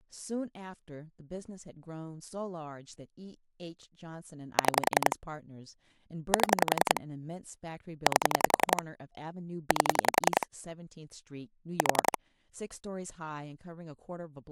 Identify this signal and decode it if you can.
Pulse dialling, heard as clicks on a phone line, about 11 pulses a second, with speech in English. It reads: 6 7 8 8 4